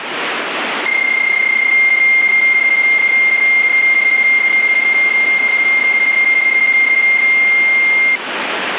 PSK31 (31.25 baud), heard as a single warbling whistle, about 2100 Hz, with radio static.